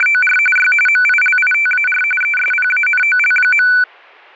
RTTY (45.45 baud, 850 Hz shift), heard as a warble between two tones, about 1900 Hz centre, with static crashes. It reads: … Y MILITAR ESPANOL.